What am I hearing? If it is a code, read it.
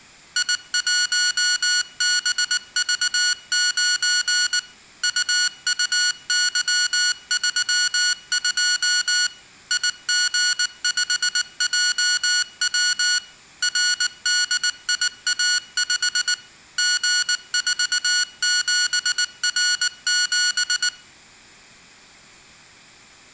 Morse code, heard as electronic beeps, machine-sent, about 19 wpm, 1460 Hz. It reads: I1BV9 UUY32 IG5JW RDIA5 G47R7